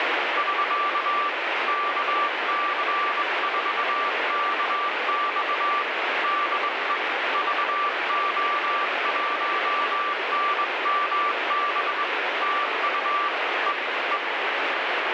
Morse code, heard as a keyed tone, hand-sent with a straight key, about 22 wpm, 1170 Hz, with heavy radio static. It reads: <SK> KC4KX DE VO1NMB TU E E